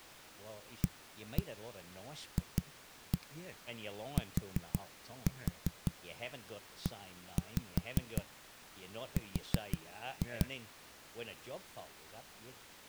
Tap code, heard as knocks on a wall, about 5 knocks a second, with speech in English. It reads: AFTER